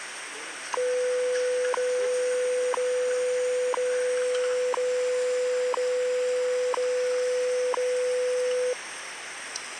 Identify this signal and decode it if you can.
Radio time signal (WWV, Colorado), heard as ticks, one a second, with radio static and the noise of a restaurant.